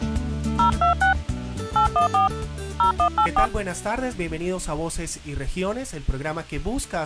DTMF, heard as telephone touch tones, dialled by hand, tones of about 110 ms. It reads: 026 814 0184